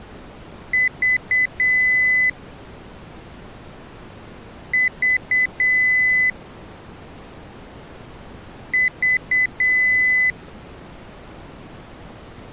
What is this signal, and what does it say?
Beep code, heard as a piezo beeper, played three times, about 2000 Hz. 3 short, 1 long.